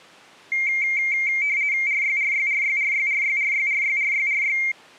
RTTY (50 baud, 170 Hz shift), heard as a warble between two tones, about 2200 Hz centre. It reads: RYRYRYRYRYRYRYRYRY